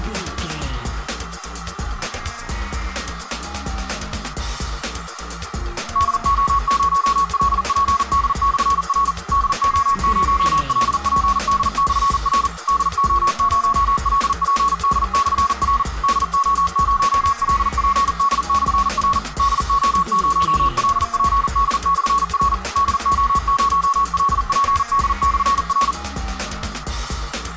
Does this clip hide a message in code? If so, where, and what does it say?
Yes: Morse code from 5.9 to 26.0 s, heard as a keyed tone, machine-sent, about 40 wpm, 1110 Hz, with radio static. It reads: DO0LPD/R DO0LPD/R DO0LPD/R DO0LPD/R DO0LPD/R DO0LPD/R